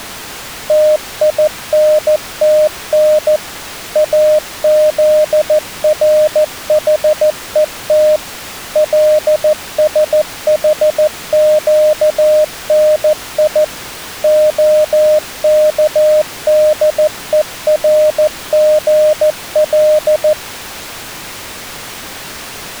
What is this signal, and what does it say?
Morse code (Hebrew alphabet), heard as a keyed tone, machine-sent, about 14 wpm, 610 Hz. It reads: תינתן אזרחות לשחקני הכדורגל